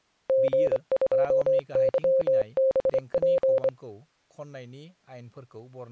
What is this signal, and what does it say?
Morse code, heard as a keyed tone, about 25 wpm, 530 Hz, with speech in Bodo. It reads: G2YBP